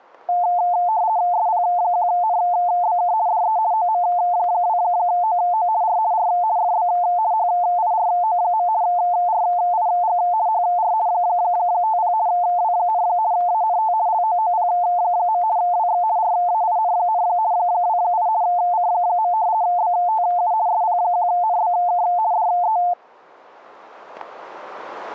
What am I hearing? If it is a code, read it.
RTTY (50 baud, 170 Hz shift), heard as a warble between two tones, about 790 Hz centre, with static crashes. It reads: SP1NBK DE OM2OO R R FB HIRO. RIG HR 50 W, ANT LOOP. WX RAIN, 28 C. BTU SP1NBK DE